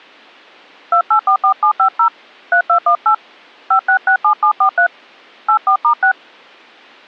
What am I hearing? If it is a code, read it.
DTMF, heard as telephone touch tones, dialled by hand, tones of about 90 ms. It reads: 2844750 3218 5667743 84*6